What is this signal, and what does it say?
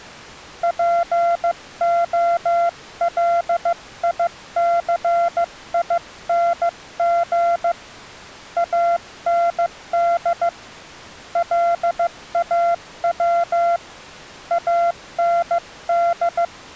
Morse code, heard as a keyed tone, hand-sent with a paddle, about 15 wpm, 690 Hz. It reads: POLICING AND LAW AND